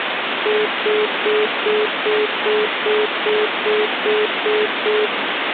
Telephone call progress tone (single-tone plan, as in most of Europe), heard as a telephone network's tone, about 420 Hz, 0.2 s on and 0.2 s off, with phone line noise. Congestion tone.